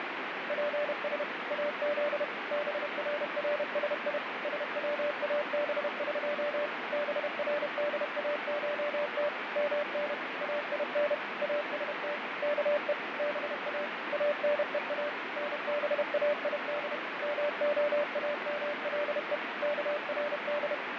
Morse code (Persian alphabet), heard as a keyed tone, machine-sent, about 31 wpm, 590 Hz, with heavy radio static and fading. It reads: پس از بررسی سوابق برداشت من این است که با انها نباید معامله کرد